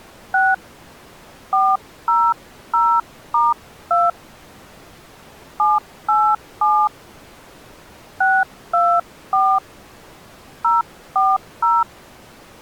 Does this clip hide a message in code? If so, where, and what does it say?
Yes: DTMF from 0.3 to 11.8 s, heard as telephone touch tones, dialled by hand, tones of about 220 ms. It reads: 6 400*2 787 624 040